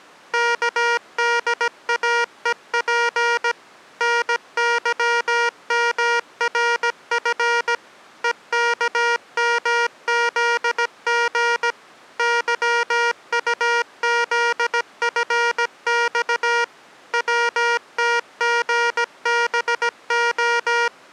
Morse code, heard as electronic beeps, machine-sent, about 17 wpm, 470 Hz. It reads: KDAEP NYMRF EKMZG YUZFX WTGBO